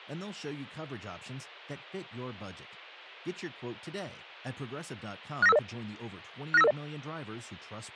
Five-tone selective call (EIA), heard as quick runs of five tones, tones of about 30 ms, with speech in English. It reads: 69550 69550